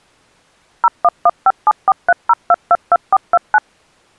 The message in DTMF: 01157430222429

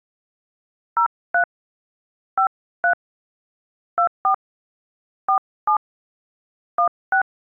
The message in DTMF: 03 53 24 47 16

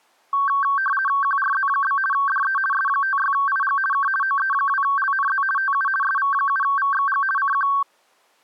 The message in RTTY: QRZ? DE S56IG K OE2LNZ TU SV7VXG CQ

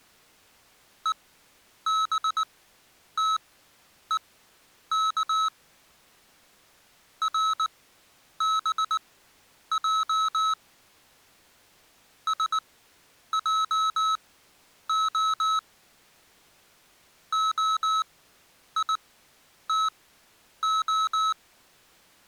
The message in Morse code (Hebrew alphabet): ובתוך רבע שעה היתה

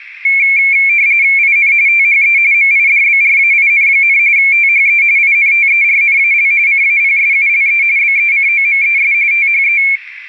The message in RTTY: IN THE MIDBRAIN, THE INTERNAL CAPSULE BECOMES THE

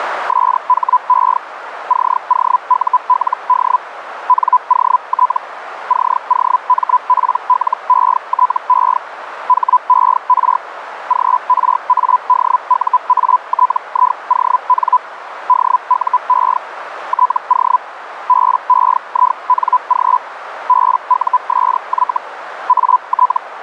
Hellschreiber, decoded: SHE COULD NOT COMPLETE HER GRADUATION DUE TO BEING BUSY AT

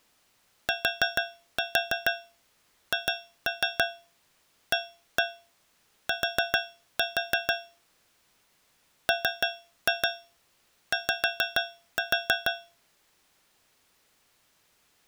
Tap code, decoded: THAT MY

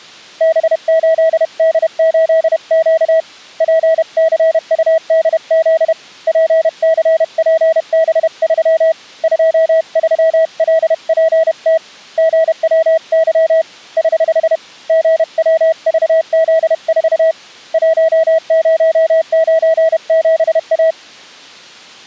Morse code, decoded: B8D8Q PCUDZ PCPB3 23LPT GWY <HH> GWVZ4 1097A

